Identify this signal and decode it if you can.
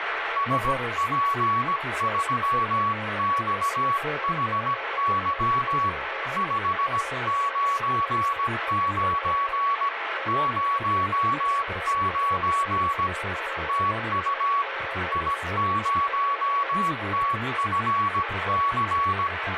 Morse code, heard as two keyed tones, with radio static and speech in Portuguese. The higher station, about 17 wpm, 1120 Hz: SP3XHY 599 09 TU I0TFC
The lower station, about 13 wpm, 540 Hz: C7B2V B49O3